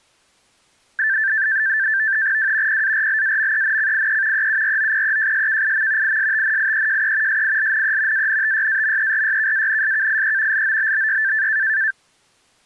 NAVTEX (SITOR-B), 100 baud, 170 Hz shift, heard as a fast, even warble, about 1650 Hz centre. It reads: W PARLAMENCIE EUROPEJSKIM ISTNIEJE SILNE ANTYAMERYKANSKIE LOBBY